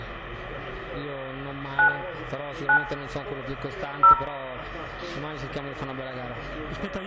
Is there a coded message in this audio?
Yes: DTMF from 1.8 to 4.1 s, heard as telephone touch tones, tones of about 100 ms, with room echo. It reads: 9 9 0